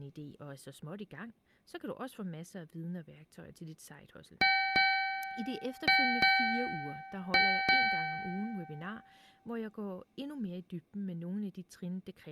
Ship's bell, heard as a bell, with speech in Danish. 6. Six half-hours of the watch have passed.